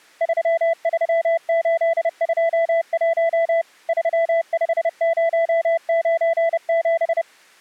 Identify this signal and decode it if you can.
Morse code, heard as a keyed tone, machine-sent, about 30 wpm, 660 Hz. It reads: 33821 35097